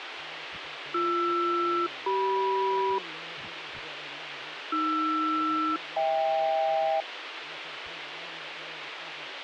Aircraft SELCAL, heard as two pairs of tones, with radio hiss. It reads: BR-CM AR-HK